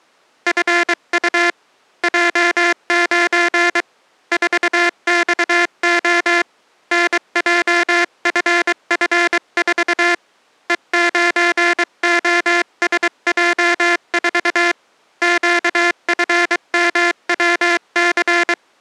Morse code, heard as a buzzer, hand-sent with a paddle, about 23 wpm. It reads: FU J9 4XO NJFF4 E9OSJ4 QFMWC